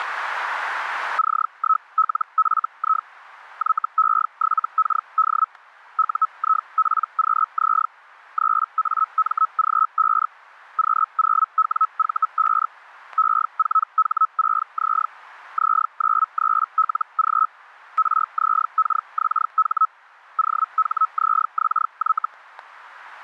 Hellschreiber (Feld-Hell, 122.5 baud), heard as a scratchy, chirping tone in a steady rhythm, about 1290 Hz, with static crashes. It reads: C1LFI YE7KD UIPQZ 3AMG5 Q0WV5 E4H6Z Z93LG RZKXH OHZXY